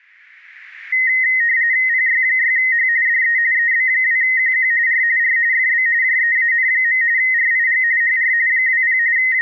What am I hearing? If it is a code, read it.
RTTY (45.45 baud, 170 Hz shift), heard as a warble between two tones, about 1950 Hz centre, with static crashes. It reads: PY6H DE EB2QQ R R FB JEAN. RIG HR 20 …